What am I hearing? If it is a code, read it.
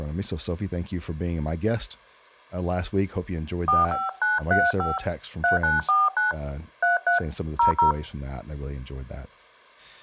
DTMF, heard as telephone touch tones, dialled by hand, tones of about 150 ms, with speech in English. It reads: 45935 3949 33 00